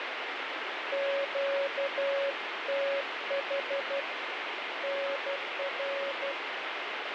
Morse code, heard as a keyed tone, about 12 wpm, 560 Hz, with radio static. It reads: QTH NR